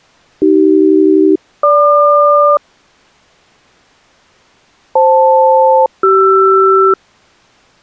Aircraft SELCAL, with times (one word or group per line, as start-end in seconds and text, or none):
0.4-2.6 AC-GQ
5.0-6.9 FL-CR